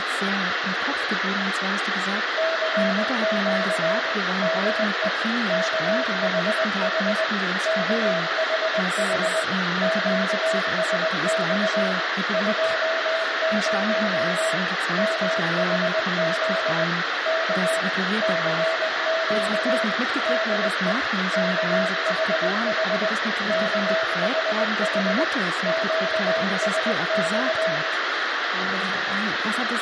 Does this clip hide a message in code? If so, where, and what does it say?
Yes: Morse code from 2.3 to 27.8 s, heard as a keyed tone, machine-sent, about 20 wpm, 650 Hz, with radio hiss, room echo and speech in German. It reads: CQ DE KHH KHH QSX 20 MHZ K CQ DE KHH KHH QSX